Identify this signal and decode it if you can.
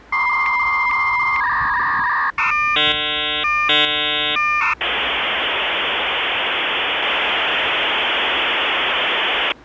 Dial-up modem handshake (V.34 or later), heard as a whistle, warbles, then hiss, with street noise.